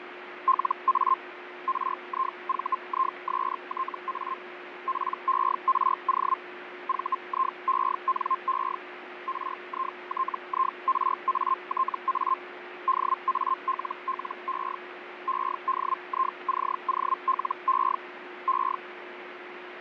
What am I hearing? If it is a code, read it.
Hellschreiber (Feld-Hell, 122.5 baud), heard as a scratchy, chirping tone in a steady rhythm, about 1060 Hz, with radio static, fading and a steady whistle near 360 Hz. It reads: LA RIVISTA PERO VIENE RITIRATA DALLE EDICOLE E